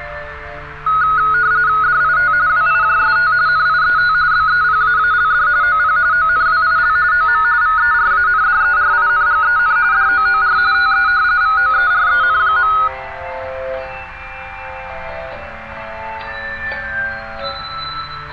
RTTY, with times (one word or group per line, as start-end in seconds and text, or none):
1.8-2.3 DIT
2.5-3.3 WIJST
3.5-4.1 NIET
4.3-5.5 BEPAALD
5.6-6.0 OP
6.1-7.0 ONWIL
7.1-7.4 OM
7.6-9.8 VERANDERINGEN
9.9-10.6 DOOR
10.7-11.1 TE
11.4-12.7 VOEREN.